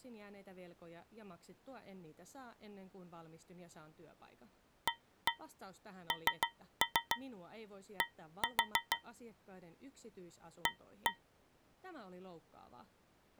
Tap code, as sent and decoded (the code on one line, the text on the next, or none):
1-1 3-3 1-4 / 1-1
AND A